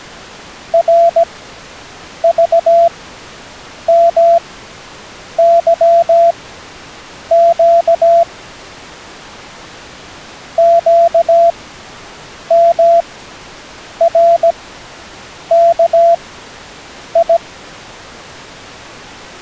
Morse code, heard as a keyed tone, machine-sent, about 17 wpm, spaced as for 7 wpm, 680 Hz. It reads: RVMYQ QMRKI